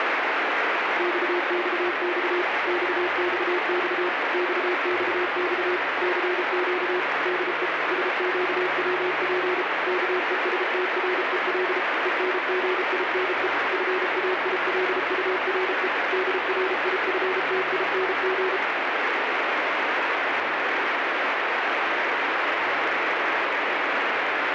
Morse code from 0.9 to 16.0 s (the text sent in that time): XXX XXX XXX CQ DE SQWP KESTREL ENGINE FAILURE